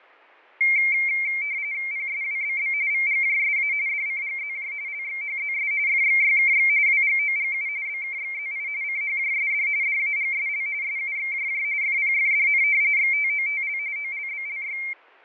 RTTY (45.45 baud, 170 Hz shift), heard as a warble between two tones, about 2200 Hz centre, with fading. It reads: PSWBB VGJSA DCGZJ LXHZS FXYKX WGOGU BKXZI CHJSD DAGSL SUXJJ FPFDN XTOTL OLBLY